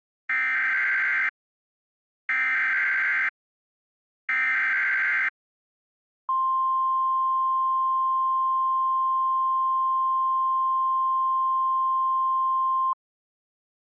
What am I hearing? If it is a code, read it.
Emergency Alert System (SAME) tones (header bursts, then the 1050 Hz attention tone), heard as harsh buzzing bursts, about 520.83 baud.